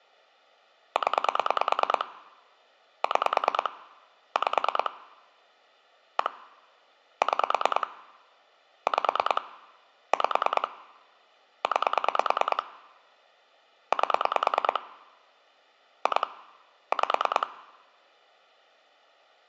Pulse dialling, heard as clicks on a phone line, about 9 pulses a second. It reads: 0 6 5 1 6 5 5 9 8 2 5